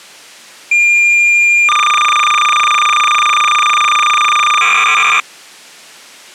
Cassette data (Kansas City type), 300 baud, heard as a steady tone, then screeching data.